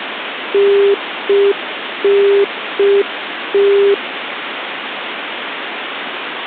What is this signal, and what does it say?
Telephone call progress tone (UK plan), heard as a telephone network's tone, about 400 Hz, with phone line noise. Congestion tone.